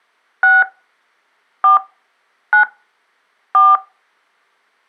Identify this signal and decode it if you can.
DTMF, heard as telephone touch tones, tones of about 160 ms. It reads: 6 4 9 4